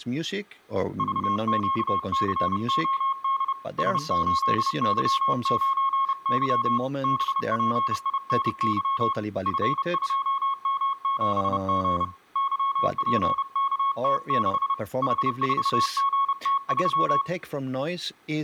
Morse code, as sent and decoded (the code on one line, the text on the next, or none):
...- --.- -.-. --- -.. / ... ---.. -.-- ----. -.-- / -... .--. .. -. -.-- / ..-. ..--- -- --... --. / -.-- .--. -.- - -.... / .... ....- --. - ...--
VQCOD S8Y9Y BPINY F2M7G YPKT6 H4GT3